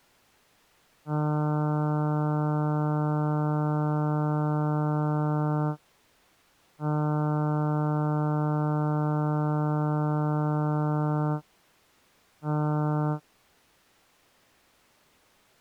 Ship horn signal, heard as a ship's horn, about 150 Hz. 2 long, 1 short. At sea: I intend to overtake on your starboard side.